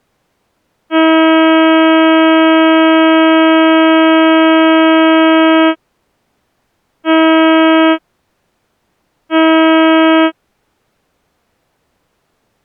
Ship horn signal, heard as a ship's horn, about 320 Hz. 1 long, 2 short. At sea: a vessel in fog that is sailing, fishing, towing or hampered.